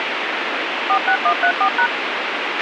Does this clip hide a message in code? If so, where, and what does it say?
Yes: DTMF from 0.9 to 1.9 s, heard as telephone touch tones, dialled by machine, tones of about 80 ms, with radio hiss and a squelch burst at the end. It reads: 46134#